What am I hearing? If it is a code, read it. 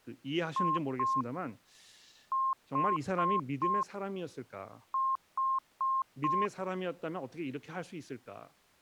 Beep code, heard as beeps, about 1060 Hz, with speech in Korean. 2-4-4.